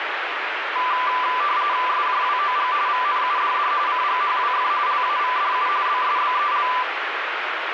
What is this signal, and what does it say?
RTTY (45.45 baud, 170 Hz shift), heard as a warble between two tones, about 1090 Hz centre, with radio static. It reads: SJWOG VNUDD CGHWF LAVDU BSBEL